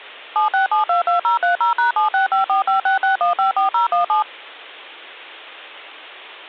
DTMF, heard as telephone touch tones, dialled by machine, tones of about 130 ms. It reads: 76722030#7654566154017